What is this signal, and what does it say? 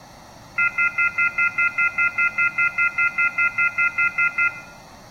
Telephone call progress tone (North American plan), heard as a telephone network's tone, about 1400, 2050, 2450, 2600 Hz, 0.1 s on and 0.1 s off, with room echo. Off-hook warning tone.